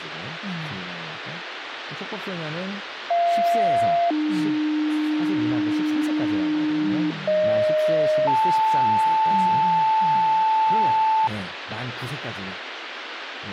Two-tone page, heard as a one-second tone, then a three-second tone, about 690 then 300 Hz, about 620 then 880 Hz, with radio hiss and speech in Korean.